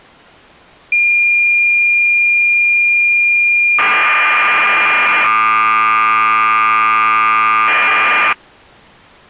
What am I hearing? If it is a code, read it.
Cassette data (Kansas City type), 1200 baud, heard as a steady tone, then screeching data.